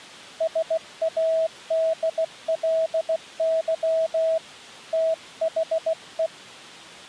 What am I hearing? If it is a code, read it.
Morse code, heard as a keyed tone, hand-sent with a bug key, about 16 wpm, 650 Hz. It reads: SADLY THE